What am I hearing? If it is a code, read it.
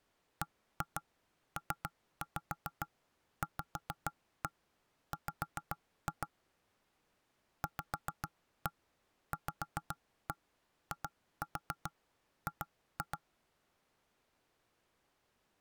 Tap code, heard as knocks on wood, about 7 knocks a second. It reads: BPVW VVIG